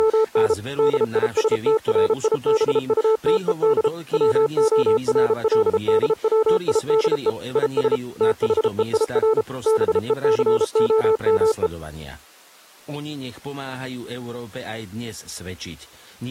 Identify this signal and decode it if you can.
Morse code, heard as a keyed tone, machine-sent, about 33 wpm, 440 Hz, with speech in Slovak. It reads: … DISTRIBUTED WORLDWIDE IS THEIR BECOME